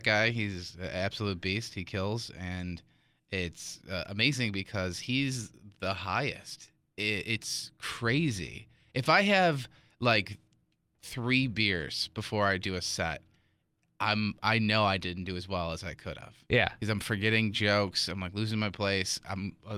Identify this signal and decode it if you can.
Speech in English. There is no code.